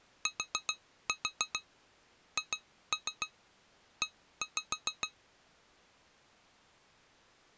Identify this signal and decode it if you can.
Tap code, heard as taps on glass, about 7 knocks a second. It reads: THE